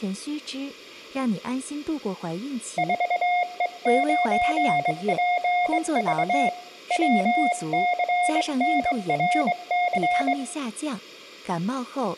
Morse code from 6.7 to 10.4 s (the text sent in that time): WCNRC